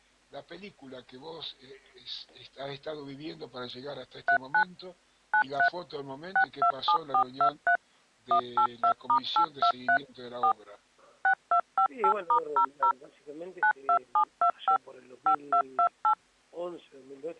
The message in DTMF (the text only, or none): 39 93 627423 182*823 4 6258*00 92725 5228